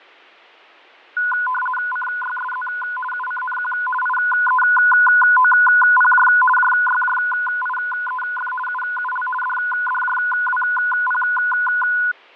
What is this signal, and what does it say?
RTTY (50 baud, 450 Hz shift), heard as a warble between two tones, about 1240 Hz centre, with fading. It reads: CYSZ UCNQ IEOPJ JYJIEF UUL DDJWP